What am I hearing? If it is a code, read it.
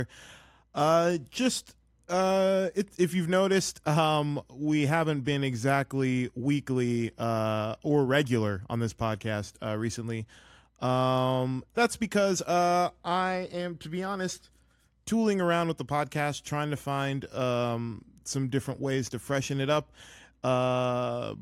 Speech in English. There is no code.